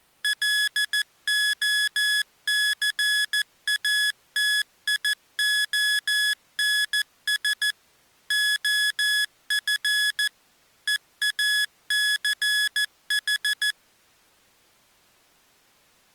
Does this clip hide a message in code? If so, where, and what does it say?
Yes: Morse code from 0.2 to 13.8 s, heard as electronic beeps, machine-sent, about 14 wpm, 1700 Hz. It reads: LOCATIONS OF EACH